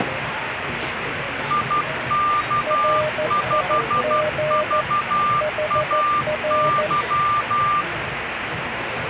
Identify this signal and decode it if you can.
Morse code, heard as two keyed tones, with radio static and the noise of a crowd indoors. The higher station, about 12 wpm, 1190 Hz: IK5VAY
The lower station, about 14 wpm, 610 Hz: RIG HR